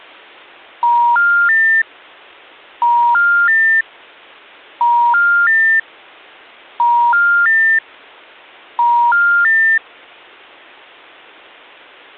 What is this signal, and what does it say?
Telephone call progress tone (ITU plan), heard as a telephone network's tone, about 950, 1400, 1800 Hz. Special information tone.